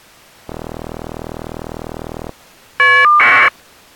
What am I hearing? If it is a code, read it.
Caller ID data burst, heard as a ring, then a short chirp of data, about 1200 baud.